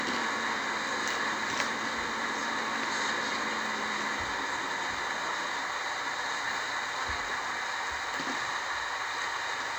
The noise inside a bus. There is no code.